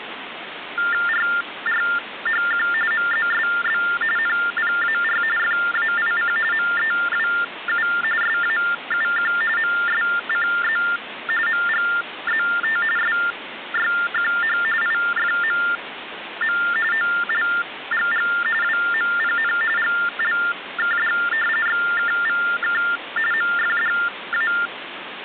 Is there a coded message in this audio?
Yes: TTY/TDD text telephone tones (45.45 baud Baudot) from 0.8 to 24.7 s, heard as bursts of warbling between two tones, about 400 Hz shift, 1600 Hz centre, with phone line noise. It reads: RRHQ MZSB NPAR FAIC MEWU SAUQ MSCZ MGZT SYQH IFMM OLGG WMPN GLKD XKVK MFDA